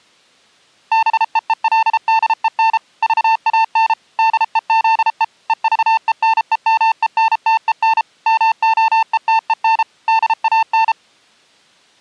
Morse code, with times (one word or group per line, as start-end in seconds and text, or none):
0.9-2.8 BEELDEN
3.0-3.9 VAN
4.2-5.2 DEZE
5.5-8.0 EVENEMENTEN
8.3-9.8 MOETEN
10.1-10.9 DAN